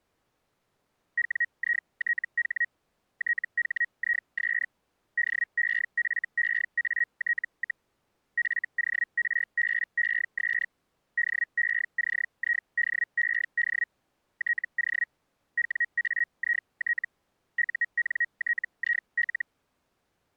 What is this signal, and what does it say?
Hellschreiber (Feld-Hell, 122.5 baud), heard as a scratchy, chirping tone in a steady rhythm, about 1900 Hz. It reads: WITH THIS DEFEAT, FORBES DECIDED TO WAIT UNTIL